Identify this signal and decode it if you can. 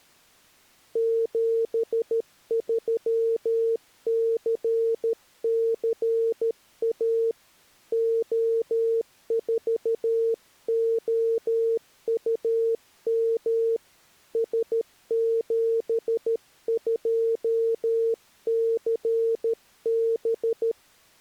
Morse code, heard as a keyed tone, hand-sent with a paddle, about 13 wpm, 460 Hz. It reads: 73CCA O4OUM S72CB